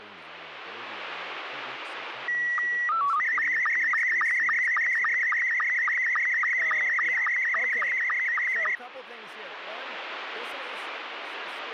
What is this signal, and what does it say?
SSTV (slow-scan television), Scottie S2, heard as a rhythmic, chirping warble, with radio static and speech in English.